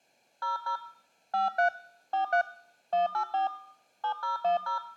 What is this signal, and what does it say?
DTMF, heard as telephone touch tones, dialled by hand, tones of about 120 ms. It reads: 00 53 43 184 7010